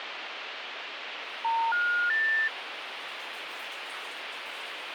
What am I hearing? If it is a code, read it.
Telephone call progress tone (North American plan), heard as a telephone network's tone, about 910, 1430, 1800 Hz, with phone line noise and the noise of a restroom. Special information tone.